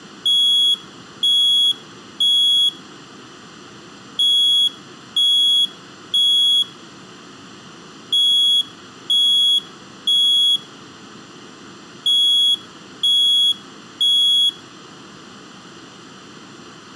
Alarm pattern, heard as an alarm's beeps, played four times, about 3350 Hz, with room echo. Temporal three. Smoke or fire, evacuate.